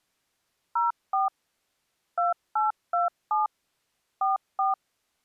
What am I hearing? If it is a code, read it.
DTMF, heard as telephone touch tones, dialled by machine, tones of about 150 ms. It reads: 04 2827 44